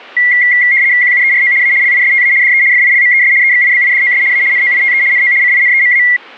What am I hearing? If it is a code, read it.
RTTY (75 baud, 170 Hz shift), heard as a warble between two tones, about 2050 Hz centre. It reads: QUERO A LISTA DE FILMES EXIBIDOS A NOITE NO CINEMA